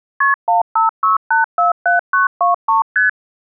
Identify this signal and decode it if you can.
Multi-frequency trunk signalling (R1, as on North American trunks), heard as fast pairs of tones, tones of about 140 ms. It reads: KP 156847923 ST